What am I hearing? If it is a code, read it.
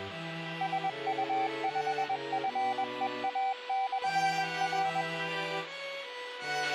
Morse code, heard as a keyed tone, machine-sent, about 21 wpm, 770 Hz, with a squelch burst at the end. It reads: SU5FEA/R